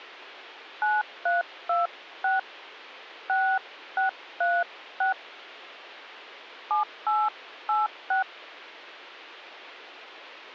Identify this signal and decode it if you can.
DTMF, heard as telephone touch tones, dialled by hand, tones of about 200 ms. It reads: 9326 6636 7886